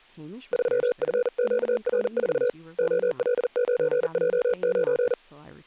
Morse code, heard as a keyed tone, hand-sent with a paddle, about 40 wpm, 490 Hz, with speech in English. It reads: 3FQR4 OL9J9